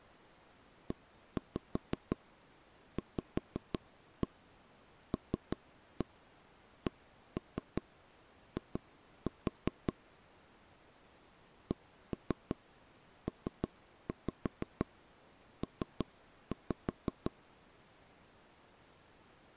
Tap code, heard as knocks on wood, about 5 knocks a second. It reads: EVLCI CPP